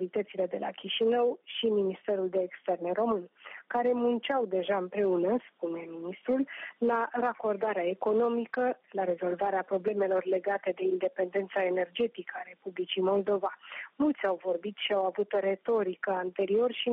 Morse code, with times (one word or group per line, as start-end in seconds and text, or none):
none